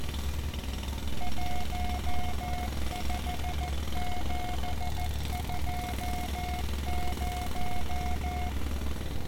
Morse code, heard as a keyed tone, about 14 wpm, 720 Hz, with street noise. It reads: 15720